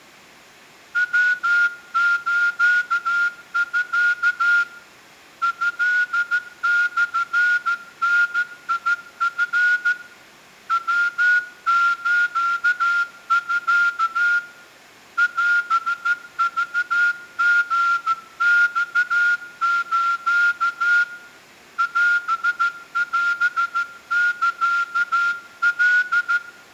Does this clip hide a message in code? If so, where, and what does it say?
Yes: Morse code (Japanese Wabun code) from 0.9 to 26.4 s, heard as a whistle, hand-sent with a straight key, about 14 wpm, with room echo. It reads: ヤスミ トモダチ ヤスミ オクリマス オオサカ